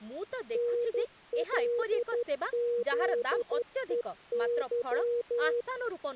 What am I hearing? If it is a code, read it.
Morse code, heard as a keyed tone, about 12 wpm, 480 Hz, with speech in Odia. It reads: NLZEY